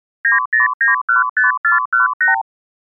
Multi-frequency trunk signalling (R2, with the far end's replies), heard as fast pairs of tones, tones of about 140 ms. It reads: 90915418